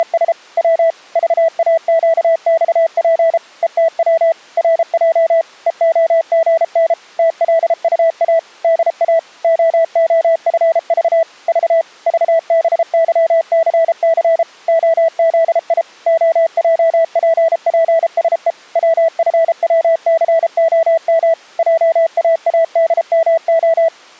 Morse code, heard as a keyed tone, machine-sent, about 33 wpm, 650 Hz. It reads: … W VAQXP ETW RJ EOGN TLUA DA OOFV V VBYCC OZI OJPPSE WFWCOM JAADMO